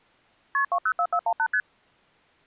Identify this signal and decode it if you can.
Multi-frequency trunk signalling (R1, as on North American trunks), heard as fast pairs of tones, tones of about 70 ms. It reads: KP 204418 ST